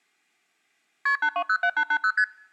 Multi-frequency trunk signalling (R1, as on North American trunks), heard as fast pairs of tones, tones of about 70 ms. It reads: KP 8207880 ST